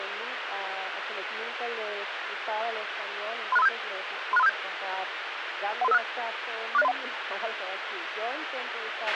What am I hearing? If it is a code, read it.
Five-tone selective call (EIA), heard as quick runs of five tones, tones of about 30 ms, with radio hiss and a squelch burst at the end. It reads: 36357 36357 13356 46031